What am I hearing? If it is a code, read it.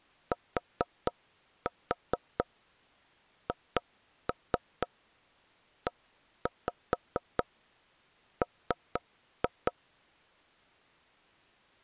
Tap code, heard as knocks on wood, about 4 knocks a second. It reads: THEM